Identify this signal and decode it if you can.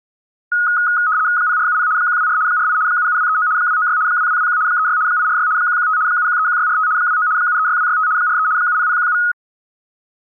RTTY (75 baud, 170 Hz shift), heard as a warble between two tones, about 1360 Hz centre. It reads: 0470 124 48 77239 296 2221 36 846 115 7131645 29 736265 43 70017